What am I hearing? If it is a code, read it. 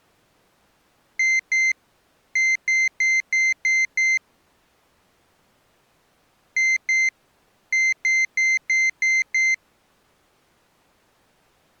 Beep code, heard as a piezo beeper, played twice, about 2100 Hz. 2-6.